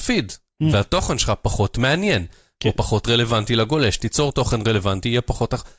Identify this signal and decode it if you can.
Speech in Hebrew. There is no code.